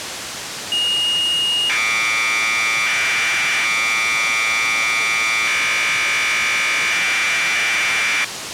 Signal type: Commodore tape loading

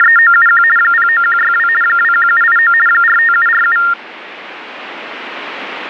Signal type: RTTY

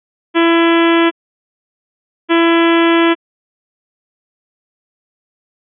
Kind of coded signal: ship horn signal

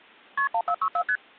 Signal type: multi-frequency trunk signalling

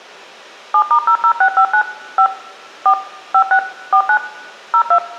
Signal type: DTMF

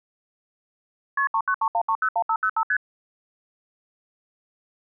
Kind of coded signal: multi-frequency trunk signalling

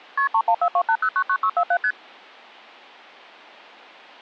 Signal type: multi-frequency trunk signalling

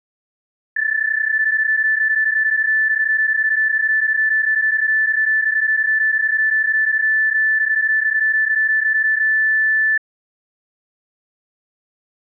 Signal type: PSK31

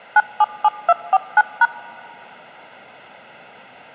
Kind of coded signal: DTMF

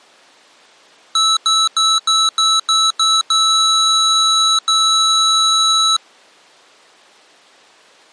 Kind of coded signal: beep code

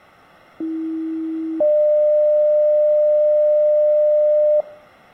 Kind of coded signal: two-tone page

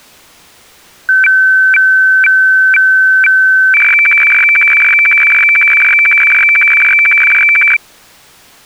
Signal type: weather fax (radiofax)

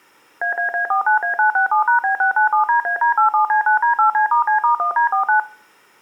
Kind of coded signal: DTMF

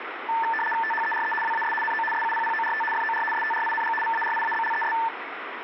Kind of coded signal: RTTY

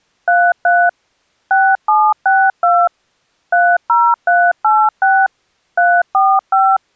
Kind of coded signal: DTMF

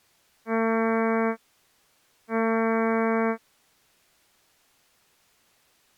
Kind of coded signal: ship horn signal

